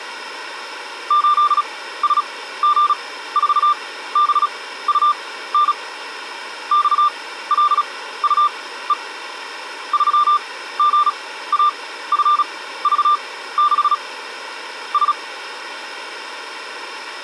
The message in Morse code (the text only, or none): 8SG4BUN XLUE 3GAFV6 S